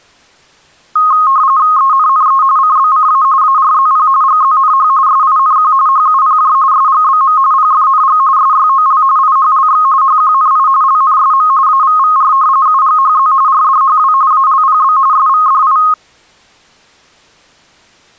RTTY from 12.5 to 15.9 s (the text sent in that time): UGHZ RDHW ALPB SVDI